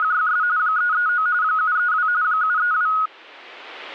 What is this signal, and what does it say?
RTTY (45.45 baud, 170 Hz shift), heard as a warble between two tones, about 1360 Hz centre. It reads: … 339 732 732